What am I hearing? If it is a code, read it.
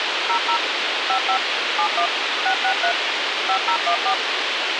DTMF, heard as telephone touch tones, dialled by machine, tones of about 90 ms, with radio hiss. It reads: 00 55 71 663 5014